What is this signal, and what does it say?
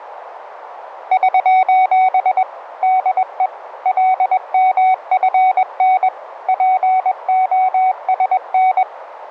Morse code, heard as a keyed tone, machine-sent, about 21 wpm, 750 Hz, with radio static. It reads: <SOS> DE LMFN POSN